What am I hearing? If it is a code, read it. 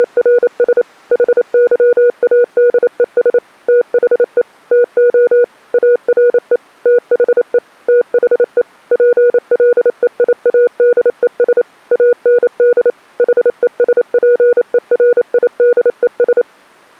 Morse code, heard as a keyed tone, machine-sent, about 28 wpm, 480 Hz. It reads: … HYADES THE TO ARE THE THE PLEIADES AND HESPERIDES